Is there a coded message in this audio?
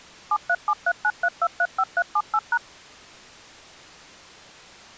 Yes: DTMF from 0.3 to 2.6 s, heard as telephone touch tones, dialled by machine, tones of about 60 ms. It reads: 737393235378#